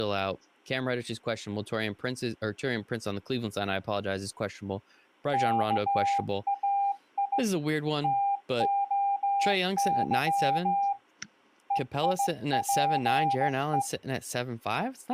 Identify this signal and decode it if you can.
Morse code (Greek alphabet), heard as a keyed tone, hand-sent with a straight key, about 16 wpm, 800 Hz, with speech in English. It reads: ΚΑΙ ΤΟΥ ΕΙΠΕ